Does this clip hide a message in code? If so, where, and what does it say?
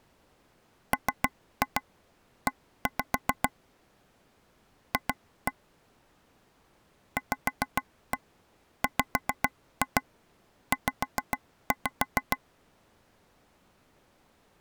Yes: tap code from 0.9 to 12.4 s, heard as taps on a table, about 7 knocks a second. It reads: ME F VWZ